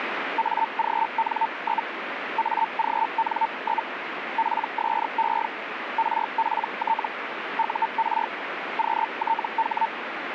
Hellschreiber (Feld-Hell, 122.5 baud), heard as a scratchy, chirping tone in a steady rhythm, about 900 Hz, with radio static. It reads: AGN? AGN? PSE RPT UR QTH